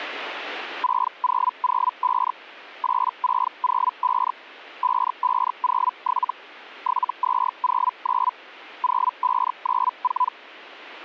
Hellschreiber (Feld-Hell, 122.5 baud), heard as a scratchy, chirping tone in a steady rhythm, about 1000 Hz. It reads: 6005 8605 5507 7209 0594